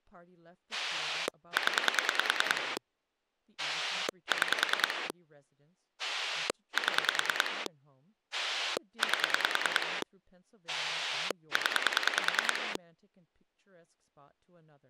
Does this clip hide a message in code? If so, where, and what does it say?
Yes: pulse dialling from 0.7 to 12.8 s, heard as a rotary dial, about 10 pulses a second, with speech in English. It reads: 0 6 7 8 0